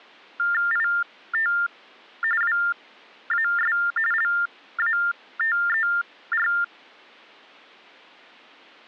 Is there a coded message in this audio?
Yes: TTY/TDD text telephone tones (45.45 baud Baudot) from 0.4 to 6.6 s, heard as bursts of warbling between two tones, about 400 Hz shift, 1600 Hz centre. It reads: IT WAS LATER